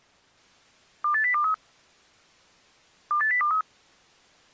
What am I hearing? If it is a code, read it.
Five-tone selective call (CCIR), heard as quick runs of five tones, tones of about 100 ms. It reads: 28023 28023